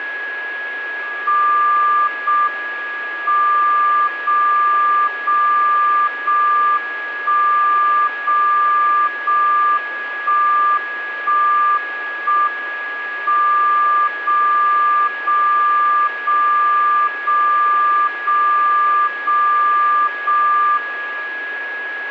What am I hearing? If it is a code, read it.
Radio time signal (JJY), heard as a tone whose level steps once a second, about 1190 Hz, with radio static and a steady whistle near 1670 Hz. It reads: 0 M 0 0 0 1 0 0 1 1 1 M 0 0 0 0 0 0 0 1